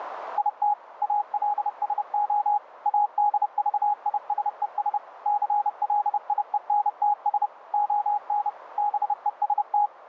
Morse code, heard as a keyed tone, machine-sent, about 30 wpm, 830 Hz, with radio static. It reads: IT ALSO ADVISES CLIENTS ON BEST